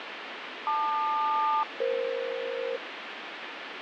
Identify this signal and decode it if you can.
Aircraft SELCAL, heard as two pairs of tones, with radio static. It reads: LQ-EF